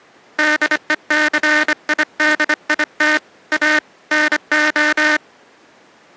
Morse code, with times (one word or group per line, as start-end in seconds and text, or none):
0.4-3.2 DECIDIT
3.5-3.8 A
4.1-5.2 NO